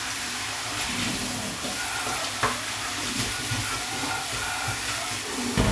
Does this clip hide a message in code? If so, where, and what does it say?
No, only kitchen noise.